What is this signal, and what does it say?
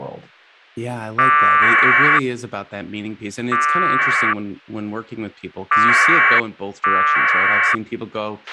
Packet radio (AX.25, as in APRS), 1200 baud, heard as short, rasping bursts, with a squelch burst at the end and speech in English.